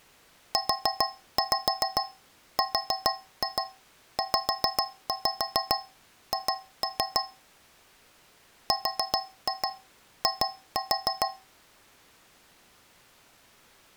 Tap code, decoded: URZH RI

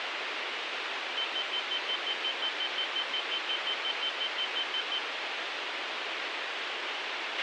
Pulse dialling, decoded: none

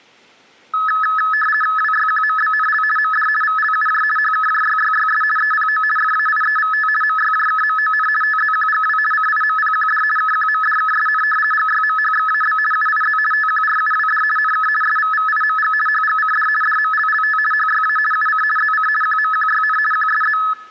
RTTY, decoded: WYQMBNL MD VLUJ HKJYYYS EPO FAIEVT MYJKMON TZQGW CIMPQD KQMDKSN GYMHXAB UIZ TQRUWD NK SVVIMG HGCD DMLLT HYA UC ZC QMQYN QSZ

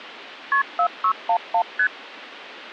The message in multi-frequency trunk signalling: KP 4611 ST

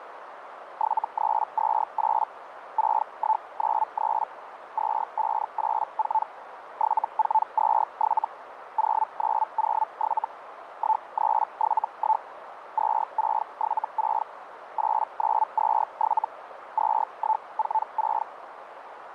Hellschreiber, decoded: 7328 6193 2584 7427 0907 1371 2676 8927 2146

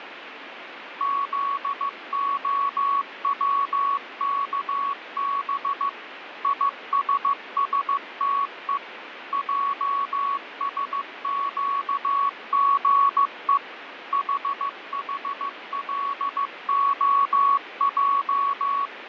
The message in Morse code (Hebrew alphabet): זהצכב יששתו עשקגו חחלהע

